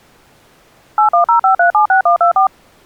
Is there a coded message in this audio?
Yes: DTMF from 1.0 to 2.5 s, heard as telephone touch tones, dialled by machine, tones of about 110 ms. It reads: 8105376124